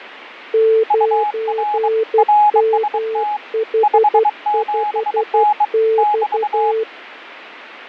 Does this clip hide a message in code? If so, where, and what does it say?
Yes: Morse code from 0.5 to 6.9 s, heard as two keyed tones, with radio static and fading. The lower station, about 12 wpm, 440 Hz: 9MH5X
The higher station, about 23 wpm, 840 Hz: UR RST 57N <BT>